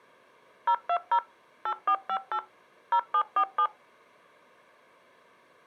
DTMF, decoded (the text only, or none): 020 8458 0747